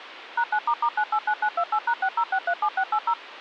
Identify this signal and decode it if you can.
DTMF, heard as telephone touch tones, dialled by machine, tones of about 70 ms, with phone line noise. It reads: #9**989928#60637680